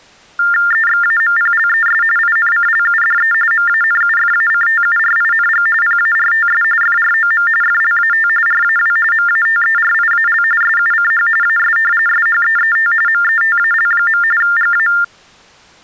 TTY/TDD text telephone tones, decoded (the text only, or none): EXAMPLES INCLUDE MANUFACTURING PARTS FROM FLAT RAW MATERIAL SUCH AS SHEET METAL. GA